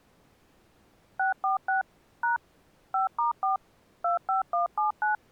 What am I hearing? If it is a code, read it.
DTMF, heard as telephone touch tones, dialled by machine, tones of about 130 ms. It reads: 646 # 5*4 25179